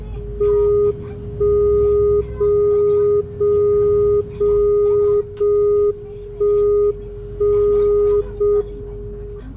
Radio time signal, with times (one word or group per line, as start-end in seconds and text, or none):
0.4-1.4 1
1.4-2.4 0
2.4-3.4 0
3.4-4.4 0
4.4-5.4 0
5.4-6.4 1
6.4-7.4 1
7.4-8.4 0
8.4-9.4 M